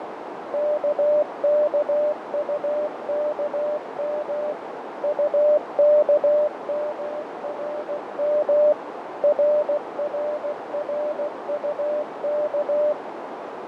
Morse code, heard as a keyed tone, machine-sent, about 16 wpm, 600 Hz, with heavy radio static, fading and a narrow filter. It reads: KKUKM UKMRM RRRUK